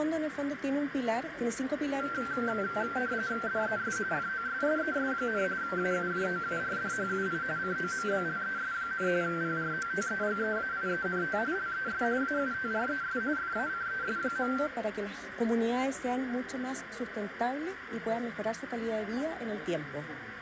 RTTY (45.45 baud, 170 Hz shift), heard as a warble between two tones, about 1460 Hz centre, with radio static, a narrow filter and room echo. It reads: DES FOSSES, AUJOURDHUI COMBLES, PROTEGEAIENT LES AUTRES FACES.